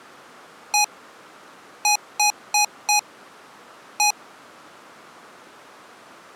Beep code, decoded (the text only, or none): 1-4-1